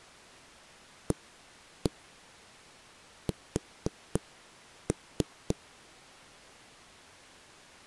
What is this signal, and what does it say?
Tap code, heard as knocks on wood, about 3 knocks a second. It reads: AS